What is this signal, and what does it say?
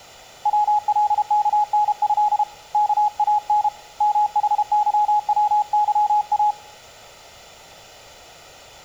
Morse code (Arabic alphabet), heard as a keyed tone, hand-sent with a paddle, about 32 wpm, 840 Hz. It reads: ولكنه كان محظوظا